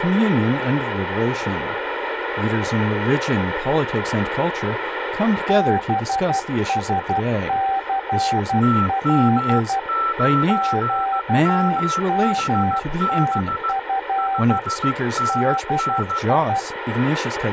Morse code, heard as two keyed tones, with radio static. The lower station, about 12 wpm, 780 Hz: BSCL QMTF DI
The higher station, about 15 wpm, 1330 Hz: TM9MHB 5NN